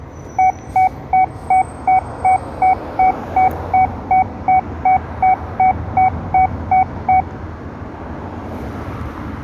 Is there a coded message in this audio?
No, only evenly repeated beeps, with room echo and street noise.